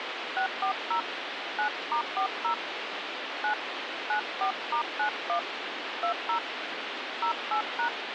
DTMF, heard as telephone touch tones, dialled by hand, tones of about 100 ms, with phone line noise. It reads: 640 9*40 9 94*91 20 08#